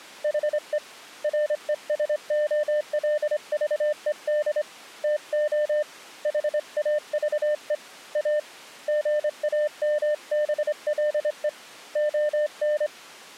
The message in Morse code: HE RESOLVED TO HAVE A GAMBLE ON

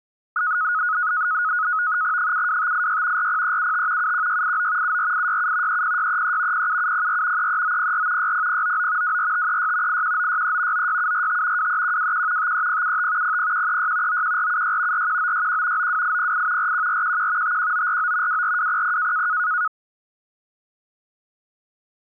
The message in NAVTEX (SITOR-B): 72586 40375 71689 74867 30633 07704 33904 60099 24536 81963 96745 23121 53075 00136 91476 41961 92808 41411 51949 24200

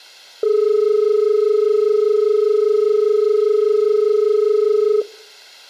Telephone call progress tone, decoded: dial tone

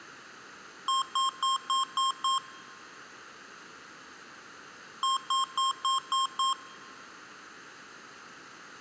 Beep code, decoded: 6 short

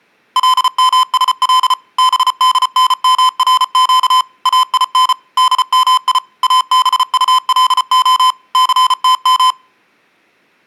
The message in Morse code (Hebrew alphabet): למשל בדנמרק אין דמי אבטלה סתם

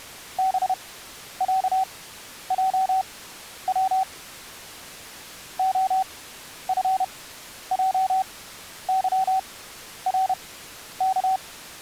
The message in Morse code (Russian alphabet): БЯЙВ ОФЙЫРК

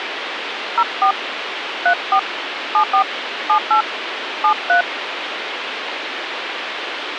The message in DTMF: 04 34 74 78 73

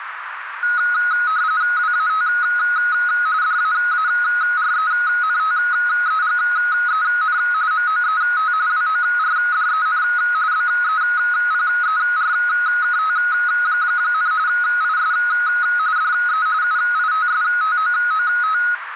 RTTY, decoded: WAT DAARENTEGEN MOET WORDEN BEPERKT, IS DE UITSTOOT

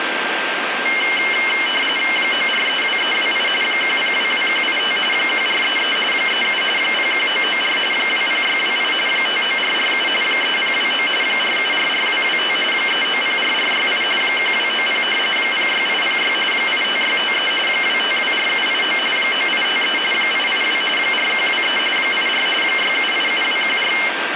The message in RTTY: 9432328 1022185 1433 37 01994 20628 59447 3029 4744225 3904468 1290 06806 85653 2524789 9853 882 4123 84 6787214

